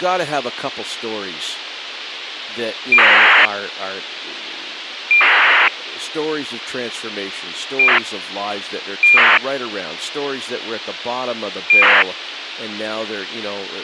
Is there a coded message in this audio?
Yes: ACARS aircraft data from 2.9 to 12.0 s, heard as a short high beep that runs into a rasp, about 2400 baud, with radio hiss and speech in English.